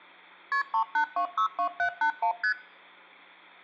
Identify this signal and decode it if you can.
Multi-frequency trunk signalling (R1, as on North American trunks), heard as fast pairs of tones, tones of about 90 ms. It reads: KP 38262781 ST